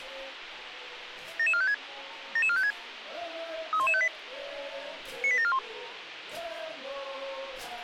Five-tone selective call (ZVEI), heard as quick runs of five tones, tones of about 70 ms, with radio hiss. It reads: 77456 77456 31158 98741